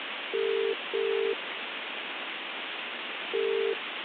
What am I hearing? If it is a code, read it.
Telephone call progress tone (as in the UK, Ireland, Australia and similar networks), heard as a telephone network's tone, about 400, 450 Hz, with phone line noise. Ringback tone.